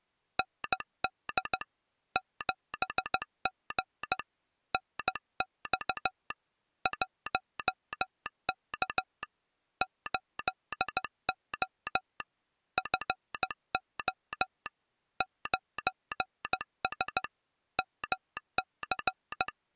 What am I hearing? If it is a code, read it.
Morse code, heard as a telegraph sounder, hand-sent with a paddle, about 15 wpm. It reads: ND 7G NX 1K 8O FO 9S MC